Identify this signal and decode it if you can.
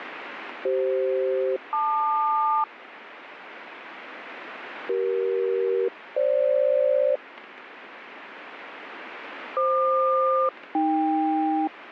Aircraft SELCAL, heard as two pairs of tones, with radio static. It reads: CF-LQ CE-FG FQ-AK